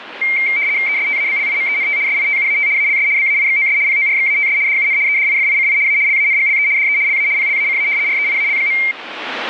RTTY (75 baud, 170 Hz shift), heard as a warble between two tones, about 2200 Hz centre, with radio static. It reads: ESTABLIMENT SITUAT ALS BAIXOS PORXATS DUN EDIFICI A LANGLE DE LA PLACA REIAL.